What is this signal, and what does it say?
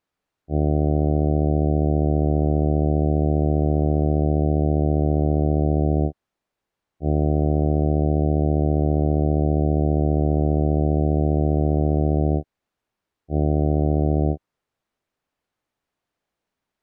Ship horn signal, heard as a ship's horn, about 80 Hz. 2 long, 1 short. At sea: I intend to overtake on your starboard side.